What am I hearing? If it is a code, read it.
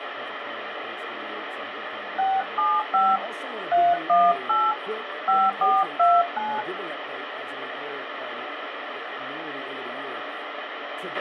DTMF, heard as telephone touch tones, dialled by hand, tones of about 220 ms, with radio hiss and a squelch burst at the end. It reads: 675 318 5429